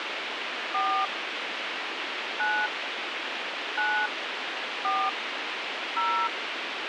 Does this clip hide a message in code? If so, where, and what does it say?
Yes: DTMF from 0.7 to 6.3 s, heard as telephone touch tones, dialled by hand, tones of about 280 ms, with radio hiss. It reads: 4 9 9 4 0